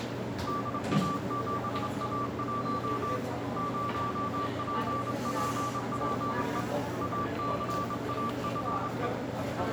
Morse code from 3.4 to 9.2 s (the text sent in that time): 0PPPE ACAFE